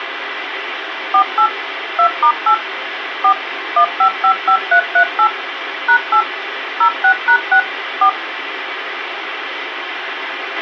DTMF, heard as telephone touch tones, dialled by machine, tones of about 80 ms, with radio hiss and a squelch burst at the end. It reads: 48 2*8 4 1555338 #8 06#6 4